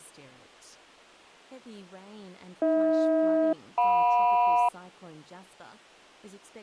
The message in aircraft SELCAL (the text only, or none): AH-JM